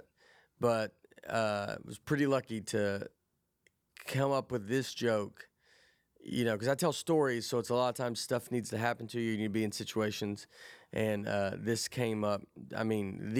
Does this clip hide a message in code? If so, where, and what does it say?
No, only speech in English.